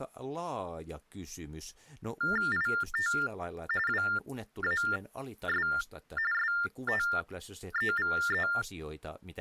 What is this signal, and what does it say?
TTY/TDD text telephone tones (45.45 baud Baudot), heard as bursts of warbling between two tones, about 400 Hz shift, 1600 Hz centre, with speech in Finnish. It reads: IT WAS STEVE